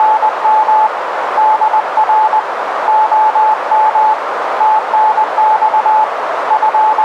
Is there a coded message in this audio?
Yes: Morse code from 0.0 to 7.0 s, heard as a keyed tone, hand-sent with a paddle, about 20 wpm, 870 Hz, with radio static and a narrow filter. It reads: … DR OM TNX …